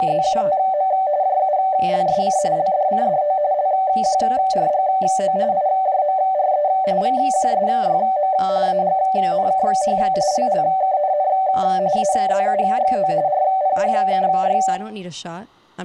RTTY (45.45 baud, 170 Hz shift), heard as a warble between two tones, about 680 Hz centre, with room echo and speech in English. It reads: … JULSC LDCDO LQRGO IJMRE VQSYM AGNKH LLKNN AZUXO RPHKY